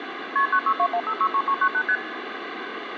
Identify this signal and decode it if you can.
Multi-frequency trunk signalling (R1, as on North American trunks), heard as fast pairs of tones, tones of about 70 ms, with phone line noise. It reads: KP 9621563398 ST